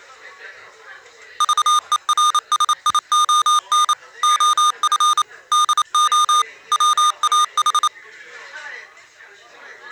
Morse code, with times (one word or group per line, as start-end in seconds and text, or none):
1.4-3.9 VERSION
4.2-5.2 OF
5.5-6.4 DO
6.7-7.9 WAH